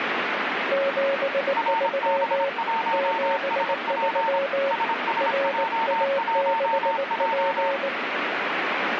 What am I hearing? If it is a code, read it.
Morse code, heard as two keyed tones, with radio static. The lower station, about 19 wpm, 550 Hz: 73 73 RA6P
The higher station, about 26 wpm, 900 Hz: RB1SP SSJ1J